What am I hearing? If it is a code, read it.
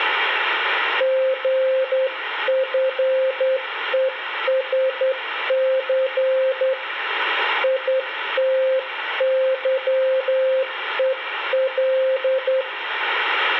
Morse code, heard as a keyed tone, hand-sent with a straight key, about 10 wpm, 520 Hz. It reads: GFESC ITYEL